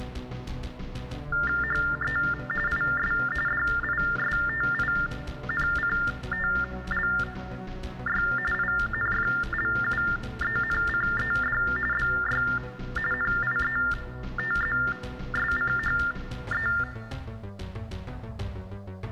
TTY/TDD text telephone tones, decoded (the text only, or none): HE IS DISTINCTLY INFLUENCED BY NIETZSCHE